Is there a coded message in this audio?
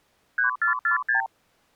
Yes: multi-frequency trunk signalling (R2, with the far end's replies) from 0.4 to 1.3 s, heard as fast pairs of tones, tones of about 120 ms. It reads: 3446